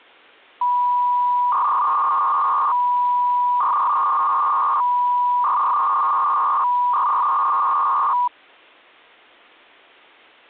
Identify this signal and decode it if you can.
300-baud modem data (V.21 tones), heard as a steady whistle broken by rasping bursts, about 300 baud, 200 Hz shift.